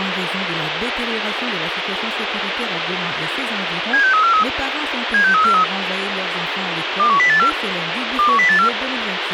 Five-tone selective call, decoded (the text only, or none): 76343 76343 21084 21084